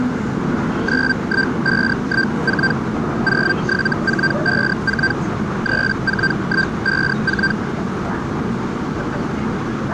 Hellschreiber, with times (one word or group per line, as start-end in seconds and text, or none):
0.9-2.7 91514
3.3-5.1 07454
5.7-7.5 34154